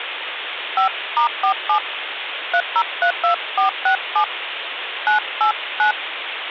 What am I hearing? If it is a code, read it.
DTMF, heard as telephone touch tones, dialled by hand, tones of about 90 ms, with phone line noise. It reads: 5*47 3032467 989